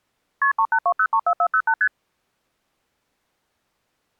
Multi-frequency trunk signalling (R1, as on North American trunks), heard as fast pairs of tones, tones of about 70 ms. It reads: KP 382034408 ST